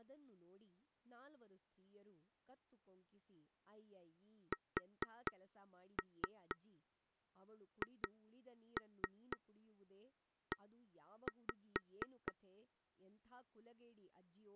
Tap code, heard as taps on a table, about 4 knocks a second, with speech in Kannada. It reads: SHE